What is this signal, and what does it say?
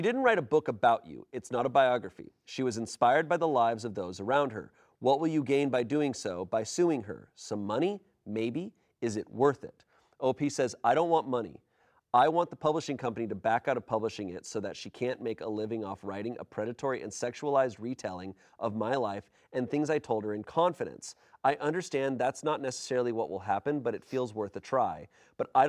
Speech in English. There is no code.